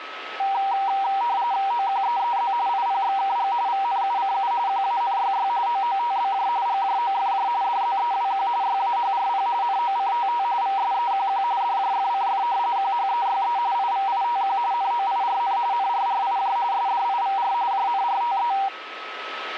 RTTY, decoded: OQEEZ IPXKG VNUCU QANYY OOTBJ GJOFJ DZEWQ YAHRP NOCTT VSEQQ DJFCF QHEYE IVITQ NOIRN NRRIJ SDIVR JNRTE

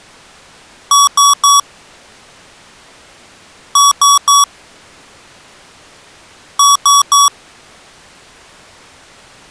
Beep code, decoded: 3 short

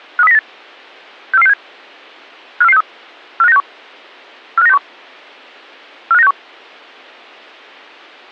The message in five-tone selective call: 53098 64467 54463 45961 45961 45961

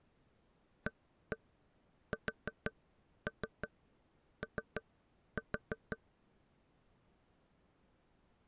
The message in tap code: ASO

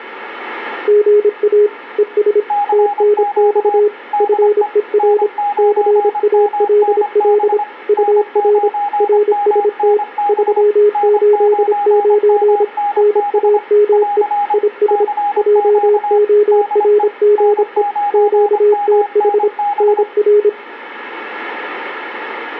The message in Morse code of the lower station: GA ES TNX FER CALL UR RST 389 NAME IS JORGE QTH NR

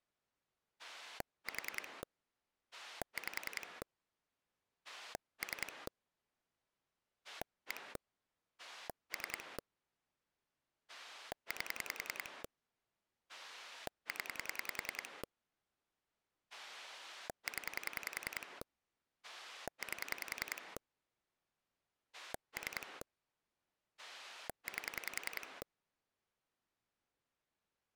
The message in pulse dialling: 4 5 3 1 3 8 0 0 8 3 8

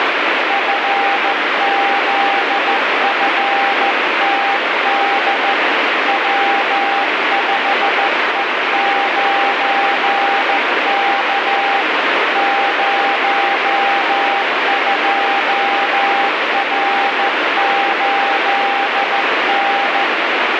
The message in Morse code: FZFTD W5E9K 02R8N

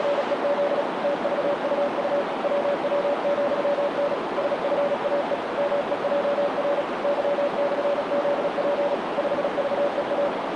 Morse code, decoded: … TVUU WW,N SFAE MEJR Y/ZP 5VEA

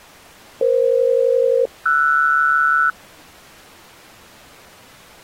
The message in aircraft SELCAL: EF-RS

